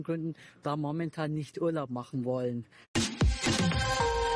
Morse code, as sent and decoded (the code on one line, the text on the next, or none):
none